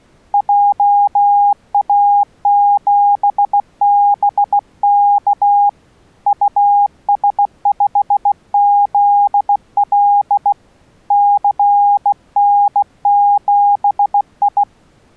Morse code, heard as a keyed tone, hand-sent with a bug key, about 16 wpm, 810 Hz. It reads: JA7BK US5ZL CN7I